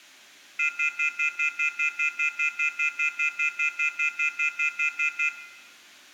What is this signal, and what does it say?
Telephone call progress tone (North American plan), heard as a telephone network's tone, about 1400, 2050, 2450, 2600 Hz, 0.1 s on and 0.1 s off, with room echo. Off-hook warning tone.